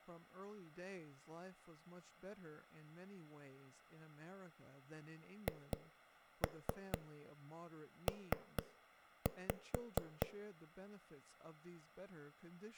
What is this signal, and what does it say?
Tap code, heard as knocks on a wall, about 4 knocks a second, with speech in English. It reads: HP